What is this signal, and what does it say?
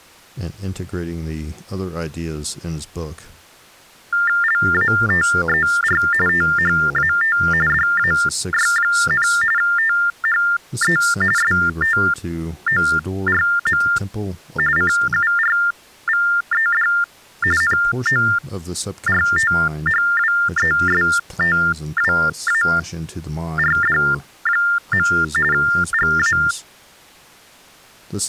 TTY/TDD text telephone tones (45.45 baud Baudot), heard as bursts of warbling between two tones, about 400 Hz shift, 1600 Hz centre, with speech in English. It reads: LATER THAT DAY, THE STORM CURVED NORTHWESTWARD. GA